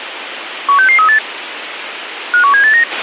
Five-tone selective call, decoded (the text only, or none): 16638 51789